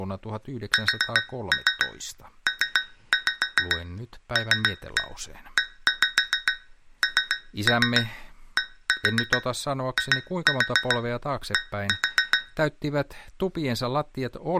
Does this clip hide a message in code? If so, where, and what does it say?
Yes: tap code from 0.7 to 12.5 s, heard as taps on a metal pipe, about 7 knocks a second, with speech in Finnish. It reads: SPLENDID